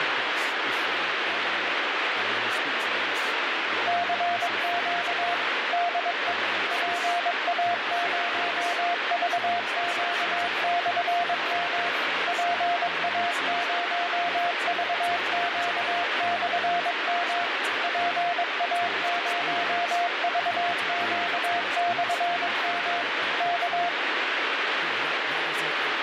Morse code, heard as a keyed tone, machine-sent, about 22 wpm, 700 Hz, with heavy radio static and speech in English. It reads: CQ DE PA0VQ/M PA0VQ/M PA0VQ/M K